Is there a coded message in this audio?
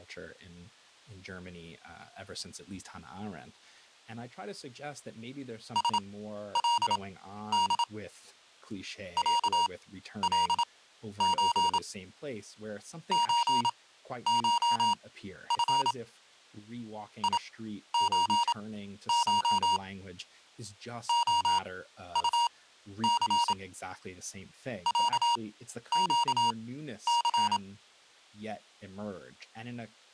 Yes: Morse code (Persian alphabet) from 5.7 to 27.6 s, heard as electronic beeps, machine-sent, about 27 wpm, spaced as for 12 wpm, 950 Hz, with speech in English. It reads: سلد صلچ چشف یچش عطث صگث